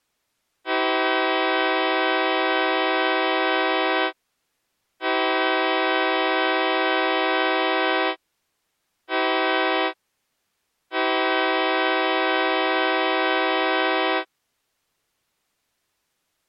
Train horn signal, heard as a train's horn. 2 long, 1 short, 1 long. On North American railways: approaching a public crossing.